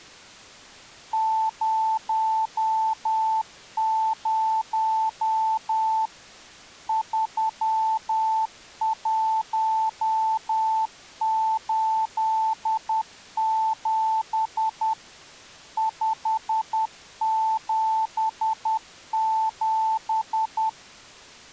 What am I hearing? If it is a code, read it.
Morse code, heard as a keyed tone, machine-sent, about 10 wpm, 880 Hz. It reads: 00 3187 577